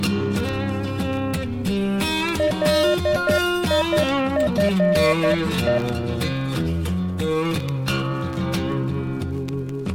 Morse code, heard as a keyed tone, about 11 wpm, 600 Hz. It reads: LIFE